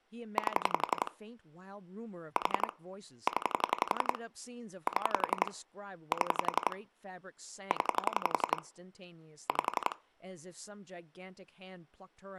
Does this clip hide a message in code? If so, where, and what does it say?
Yes: pulse dialling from 0.4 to 9.9 s, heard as clicks on a phone line, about 11 pulses a second, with speech in English. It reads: 8 4 0 7 7 0 5